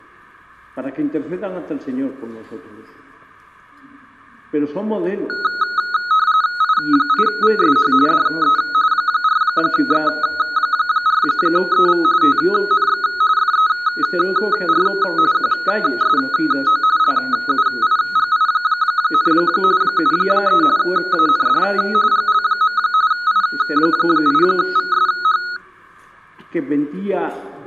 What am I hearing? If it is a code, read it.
RTTY (45.45 baud, 170 Hz shift), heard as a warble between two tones, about 1360 Hz centre. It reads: I8VSH DE 4X4EV TNX FER QSO LUIGI, 73 AND GL. I8VSH